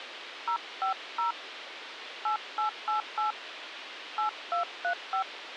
DTMF, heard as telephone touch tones, dialled by hand, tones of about 110 ms, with radio hiss. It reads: 050 8888 8235